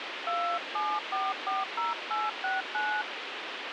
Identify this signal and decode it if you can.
DTMF, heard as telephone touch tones, dialled by hand, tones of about 230 ms, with radio hiss. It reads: 27440869